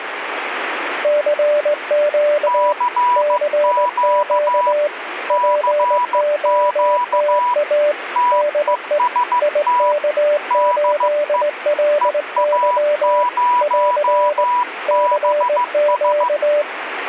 Morse code, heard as two keyed tones, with radio static. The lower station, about 19 wpm, 590 Hz: CQ CQ POTA DE IK8LY <AR> CQ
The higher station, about 15 wpm, 980 Hz: CQ CQ TEST DE EA0BS